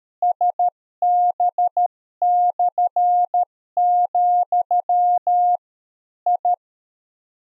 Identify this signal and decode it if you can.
Morse code, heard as a keyed tone, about 13 wpm, 710 Hz. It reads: SB/, I